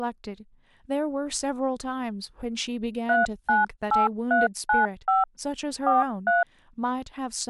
DTMF, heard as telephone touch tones, dialled by hand, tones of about 160 ms, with speech in English. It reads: 398395 43